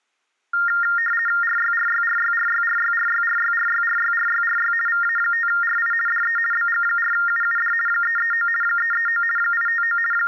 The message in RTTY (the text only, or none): RYRYRYRYRYRYRYRYRYRYRY VA5RI DE BG4UUD 339 339 859 …